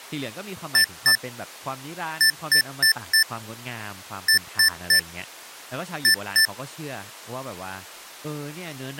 Beep code, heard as beeps from a small speaker, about 1750 Hz, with speech in Thai. 2-4-3-2.